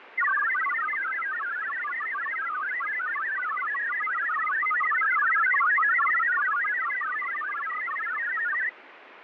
Multi-tone FSK (Olivia or MFSK type), about 1000 Hz wide, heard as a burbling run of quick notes, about 62.5 baud, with radio static and fading.